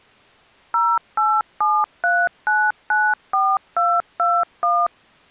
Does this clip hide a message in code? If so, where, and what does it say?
Yes: DTMF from 0.7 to 4.9 s, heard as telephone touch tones, dialled by machine, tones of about 240 ms. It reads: 0873994221